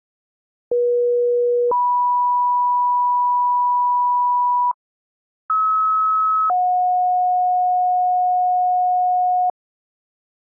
Two-tone page, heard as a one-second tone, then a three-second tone, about 480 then 980 Hz, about 1290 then 730 Hz.